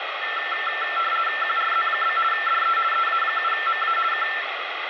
RTTY (50 baud, 450 Hz shift), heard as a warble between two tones, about 1550 Hz centre, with radio static. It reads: QRZ? DE EA7MA K